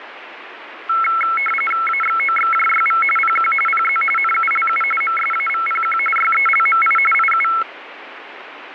RTTY (45.45 baud, 850 Hz shift), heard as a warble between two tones, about 1750 Hz centre, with radio static. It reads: AXOXJYV PQ PZ NULU MSAVPQ YELMI IU